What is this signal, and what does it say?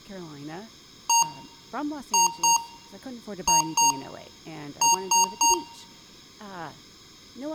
Beep code, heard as beeps from a small speaker, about 930 Hz, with room echo and speech in English. 1-2-2-3. In Phoenix BIOS tables: BIOS ROM checksum failure.